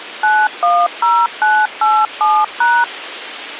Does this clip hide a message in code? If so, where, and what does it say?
Yes: DTMF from 0.2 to 2.8 s, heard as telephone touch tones, dialled by machine, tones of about 240 ms, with radio hiss. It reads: 910987#